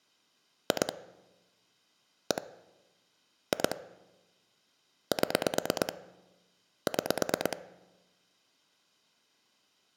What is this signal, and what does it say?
Pulse dialling, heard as clicks on a phone line, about 9 pulses a second. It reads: 2 1 2 7 6